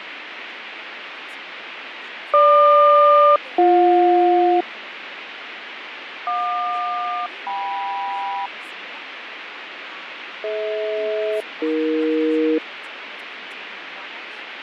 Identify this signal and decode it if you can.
Aircraft SELCAL, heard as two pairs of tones, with radio static, fading and speech in Hebrew. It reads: GQ-BJ JQ-KM DH-AE